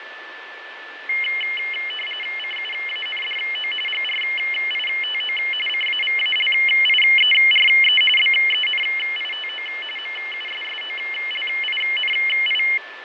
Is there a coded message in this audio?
Yes: RTTY (45.45 baud, 850 Hz shift) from 1.1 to 12.8 s, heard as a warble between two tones, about 2550 Hz centre, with radio static, fading and a steady whistle near 1750 Hz. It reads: CUANDO GRITO CAVALIERE BENITO MUSSOLINI